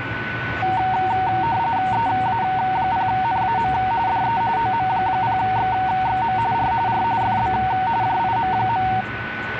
RTTY (45.45 baud, 170 Hz shift), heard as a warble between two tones, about 840 Hz centre, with radio static, a steady whistle near 1490 Hz and the noise inside a car. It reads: EA0NAM DE OM0XXM R R FB JIM.